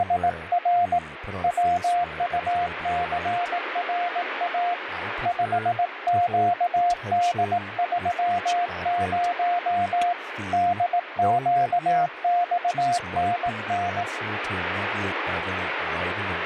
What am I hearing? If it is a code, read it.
Morse code, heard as a keyed tone, hand-sent with a paddle, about 18 wpm, 700 Hz, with radio static and speech in English. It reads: … WUCRA 5QD30 DQXNN